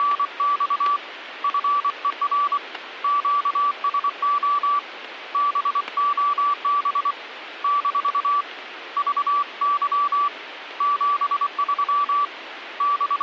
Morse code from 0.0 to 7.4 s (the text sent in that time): … FER QSO BOB